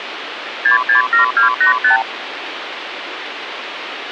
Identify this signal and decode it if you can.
Multi-frequency trunk signalling (R2, with the far end's replies), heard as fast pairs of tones, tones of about 120 ms, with phone line noise. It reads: 667285